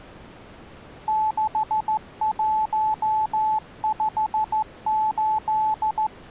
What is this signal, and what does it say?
Morse code, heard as a keyed tone, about 14 wpm, 870 Hz. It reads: 6158